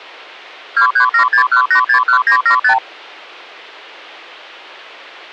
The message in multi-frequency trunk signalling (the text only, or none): 23761861975